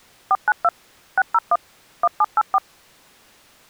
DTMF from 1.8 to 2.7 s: 1784

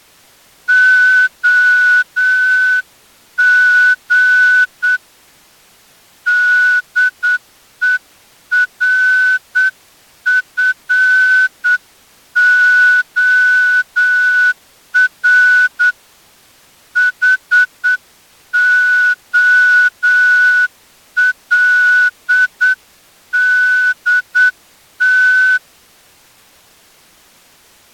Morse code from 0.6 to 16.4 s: OG DERFOR

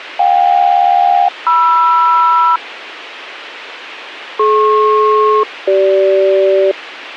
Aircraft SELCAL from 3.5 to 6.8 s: DP-CG

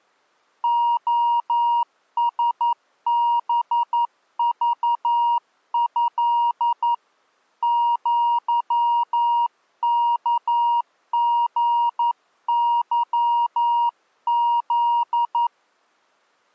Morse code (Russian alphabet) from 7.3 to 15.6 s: ЪКГЫЗ

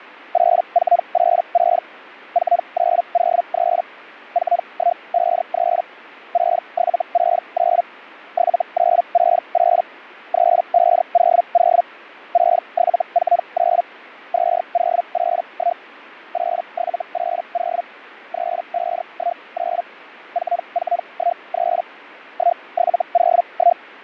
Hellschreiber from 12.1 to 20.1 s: 6749 2081 8780 3519

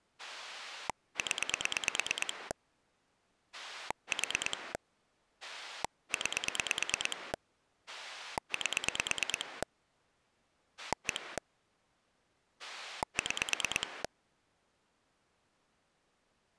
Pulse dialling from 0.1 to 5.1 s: 0 4

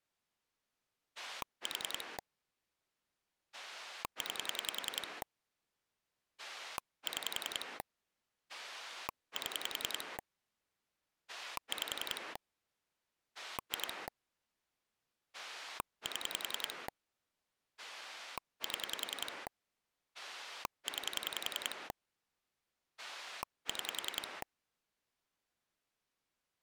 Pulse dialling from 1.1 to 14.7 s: 4 9 6 7 5 2

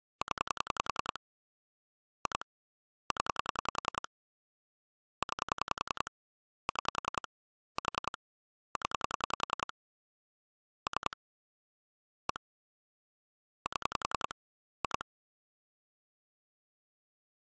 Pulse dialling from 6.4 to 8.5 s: 6 4

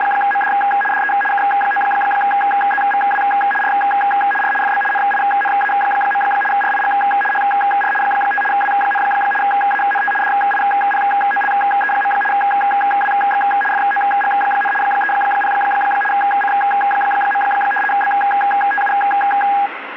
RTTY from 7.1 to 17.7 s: HR 5 W, ANT DIPOLE. WX FOG, 30 C.

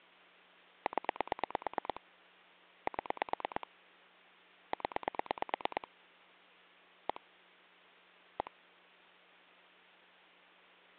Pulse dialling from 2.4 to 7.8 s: 7 0 1

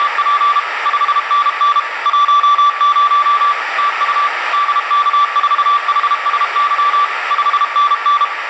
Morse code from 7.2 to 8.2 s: 5NN

